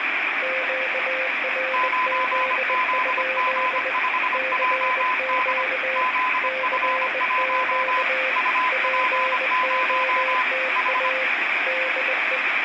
Morse code, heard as two keyed tones, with radio static and room echo. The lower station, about 20 wpm, 520 Hz: QRZ? CQ CQ POTA DE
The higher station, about 25 wpm, 1010 Hz: 9ZG5JD ZF1 UP0 H